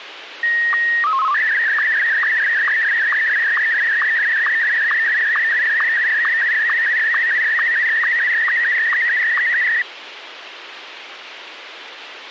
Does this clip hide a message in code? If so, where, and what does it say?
Yes: SSTV (slow-scan television), Martin M1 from 0.4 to 9.8 s, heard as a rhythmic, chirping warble, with radio hiss.